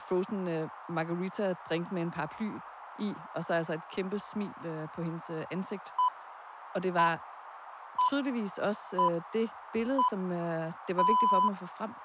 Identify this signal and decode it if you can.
Radio time signal (six pips, as the Greenwich Time Signal), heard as pips, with radio static and speech in Danish.